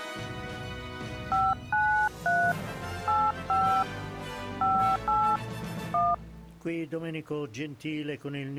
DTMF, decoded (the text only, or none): 593 85 58 1